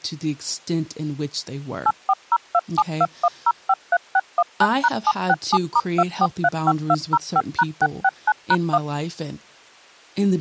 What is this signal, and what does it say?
DTMF, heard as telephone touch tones, dialled by machine, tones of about 50 ms, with speech in English. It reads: 8402721053619#767*2435205#669#1